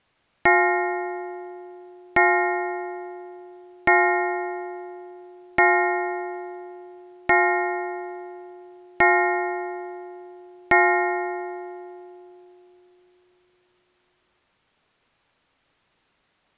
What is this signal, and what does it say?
Clock strike, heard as a bell. 7. Seven o'clock.